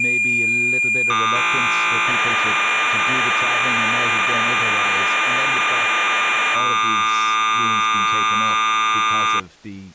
Cassette data (Kansas City type), 1200 baud, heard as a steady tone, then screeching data, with speech in English.